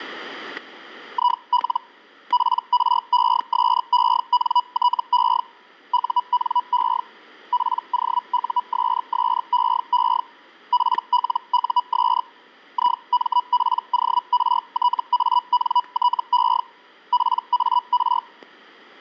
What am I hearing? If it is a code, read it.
Hellschreiber (Feld-Hell, 122.5 baud), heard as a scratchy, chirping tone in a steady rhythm, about 980 Hz, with static crashes. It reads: IL PRESENTE UNE POUSSEE PLUS IMPORTANTE PAR